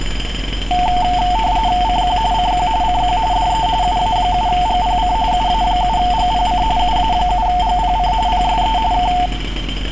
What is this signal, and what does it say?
RTTY (45.45 baud, 170 Hz shift), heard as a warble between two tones, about 810 Hz centre, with street noise. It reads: CQ CQ CQ DE UA7GPC UA7GPC UA7GPC PSE K